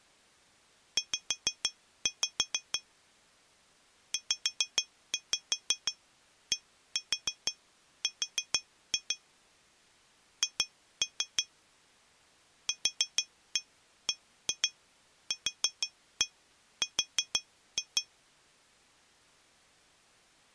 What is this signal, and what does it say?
Tap code, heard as taps on glass, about 6 knocks a second. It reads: Z ZDR H QBQR